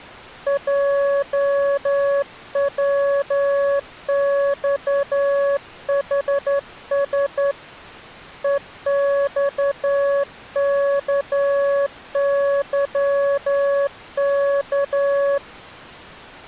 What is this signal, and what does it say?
Morse code, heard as a keyed tone, hand-sent with a straight key, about 11 wpm, 560 Hz. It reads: JWXHS EXKYK